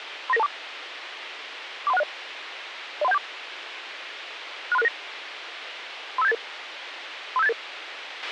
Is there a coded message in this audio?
Yes: five-tone selective call (EIA) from 0.3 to 7.5 s, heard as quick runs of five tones, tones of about 30 ms, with radio hiss and a squelch burst at the end. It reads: 39924 43160 03174 63669 35788 35788